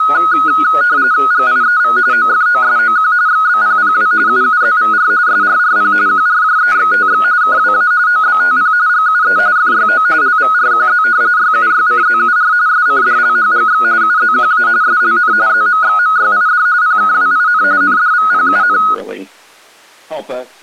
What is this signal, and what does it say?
RTTY (45.45 baud, 170 Hz shift), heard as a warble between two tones, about 1360 Hz centre. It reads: GIEV OFOSOQ XBPPW UUZVR SRRP QRJEXTX KWA OBTP GUE FYO LVRQZ YUYCZUR SCDLHGX UZQA SLN ZMXMYID PKWIN NDVPUN